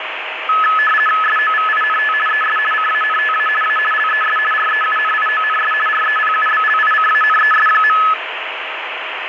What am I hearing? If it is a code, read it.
RTTY (50 baud, 450 Hz shift), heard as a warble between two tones, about 1500 Hz centre, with radio static and a steady whistle near 630 Hz. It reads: SOVINT ES CANTA A LES REUNIONS REPUBLICANES.